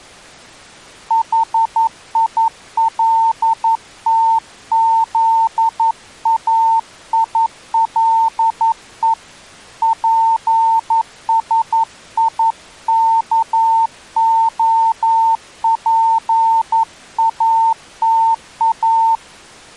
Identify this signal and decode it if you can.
Morse code, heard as a keyed tone, hand-sent with a paddle, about 11 wpm, 900 Hz. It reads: HILTZAILE PSIKOPATA